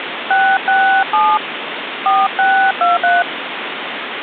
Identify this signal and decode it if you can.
DTMF, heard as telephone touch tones, dialled by hand, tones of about 290 ms, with phone line noise. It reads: 667 4623